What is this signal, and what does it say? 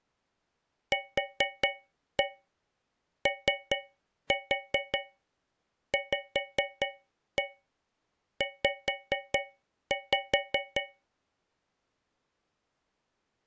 Tap code, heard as taps on a metal pipe, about 4 knocks a second. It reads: QOVZ